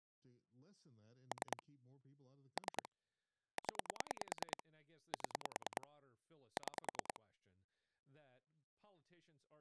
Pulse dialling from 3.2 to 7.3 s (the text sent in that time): 0 7 6